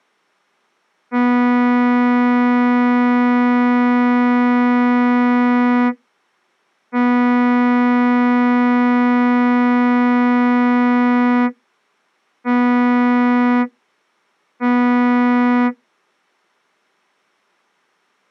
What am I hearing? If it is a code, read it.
Ship horn signal, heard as a ship's horn, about 240 Hz. 2 long, 2 short. At sea: I intend to overtake on your port side.